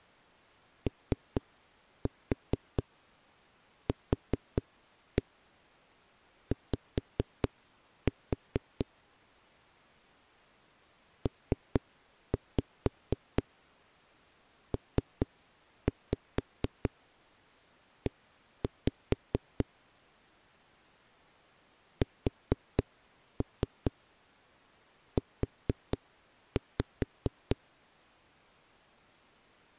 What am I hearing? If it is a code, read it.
Tap code, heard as knocks on a wall, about 4 knocks a second. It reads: OQY PPE SU